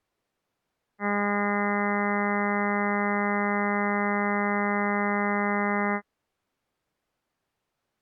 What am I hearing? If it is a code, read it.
Ship horn signal, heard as a ship's horn, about 200 Hz. 1 long. At sea: a vessel nearing a blind bend, or under power and making way in fog.